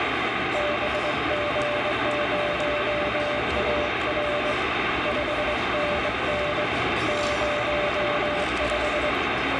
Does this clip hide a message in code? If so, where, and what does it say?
Yes: Morse code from 0.5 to 9.2 s, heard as a keyed tone, hand-sent with a straight key, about 22 wpm, 590 Hz, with heavy radio static and the noise of a restaurant. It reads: BG0AR 5NN 05